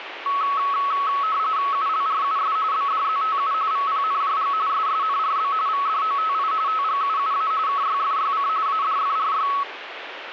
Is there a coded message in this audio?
Yes: RTTY (45.45 baud, 170 Hz shift) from 0.3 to 9.6 s, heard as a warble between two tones, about 1200 Hz centre, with radio static. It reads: ULRUS BDZTU VPNJG SSNRB VDOTI TGUUA KYFYC ADFRY